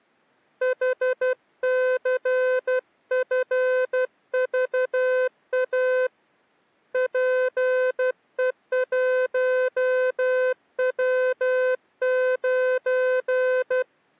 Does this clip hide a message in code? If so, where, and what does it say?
Yes: Morse code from 0.6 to 13.9 s, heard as a keyed tone, hand-sent with a paddle, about 12 wpm, 510 Hz. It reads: HCFVA PE1W9